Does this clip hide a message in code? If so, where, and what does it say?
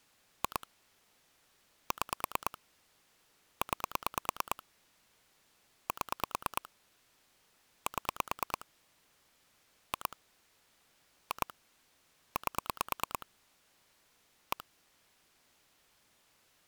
Yes: pulse dialling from 0.4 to 14.6 s, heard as clicks on a phone line, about 9 pulses a second. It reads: 2 6 9 7 7 2 2 8 1